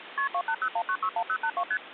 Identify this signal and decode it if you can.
Multi-frequency trunk signalling (R1, as on North American trunks), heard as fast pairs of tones, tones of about 70 ms, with phone line noise. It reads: KP 2801961082 ST